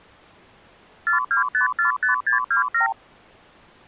Multi-frequency trunk signalling (R2, with the far end's replies), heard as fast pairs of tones, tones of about 120 ms. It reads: 42545627